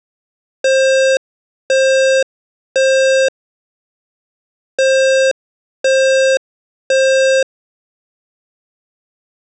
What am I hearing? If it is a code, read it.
Alarm pattern, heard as an alarm's beeps, played twice, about 530 Hz. Temporal three. Smoke or fire, evacuate.